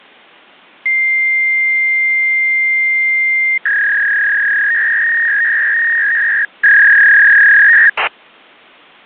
Fax machine handshake, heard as a long tone and a warble.